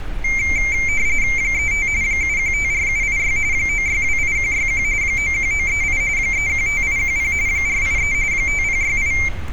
RTTY (45.45 baud, 170 Hz shift), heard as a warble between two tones, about 2200 Hz centre, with street noise. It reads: 35 7154786 9628161 91938 315810 483 5068